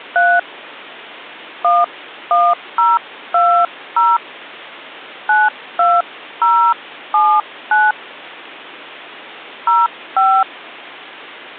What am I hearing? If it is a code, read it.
DTMF, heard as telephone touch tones, dialled by hand, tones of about 230 ms. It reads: 3 11020 92079 05